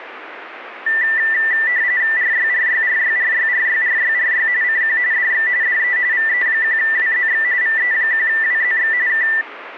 RTTY (45.45 baud, 170 Hz shift), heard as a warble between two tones, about 1900 Hz centre, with radio static. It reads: RYRYRYRYRYRYRY CQ DX DE VE1WZX VE1WZX K